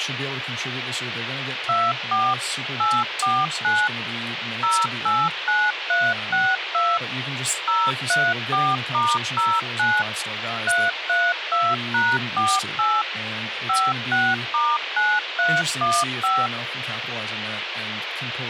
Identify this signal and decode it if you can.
DTMF, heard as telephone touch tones, dialled by machine, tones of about 230 ms, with radio hiss and speech in English. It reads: 24 849 089362 034*09 332#48 56*9315